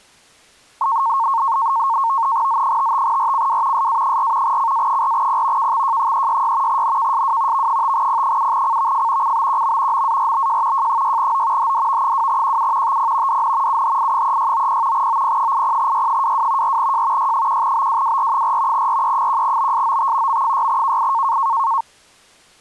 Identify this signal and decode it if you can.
NAVTEX (SITOR-B), 100 baud, 170 Hz shift, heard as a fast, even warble, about 1000 Hz centre. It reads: Z55RCW SA4 CA4P KXJ366 NKSW V5P7CVF CBQM MARBJ J6O HDV2QU TP DN UHI3690 OP80Y22 4J Y1BWWR4 RE1BSOT M6KI